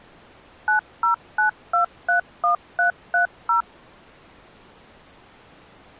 DTMF, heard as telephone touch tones, dialled by machine, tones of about 120 ms. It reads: 909231330